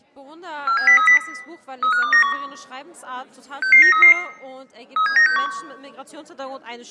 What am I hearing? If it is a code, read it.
Five-tone selective call (CCIR), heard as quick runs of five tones, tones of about 100 ms, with room echo. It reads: 47030 35291 66933 37961